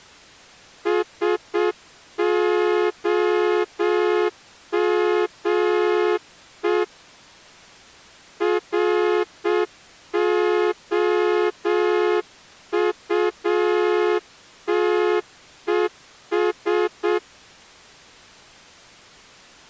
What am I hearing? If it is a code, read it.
Morse code, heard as a horn, hand-sent with a straight key, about 7 wpm. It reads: SOME ROUTES